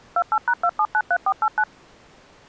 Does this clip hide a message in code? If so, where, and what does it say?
Yes: DTMF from 0.2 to 1.6 s, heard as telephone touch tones, dialled by machine, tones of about 60 ms. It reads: 28#2793489